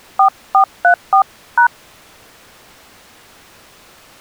DTMF, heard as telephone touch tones, dialled by hand, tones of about 90 ms. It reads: 4434#